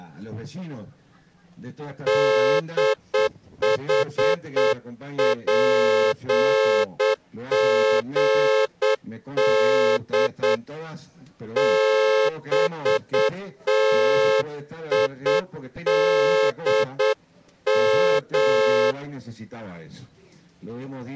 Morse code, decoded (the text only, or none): DHPGD BTIDM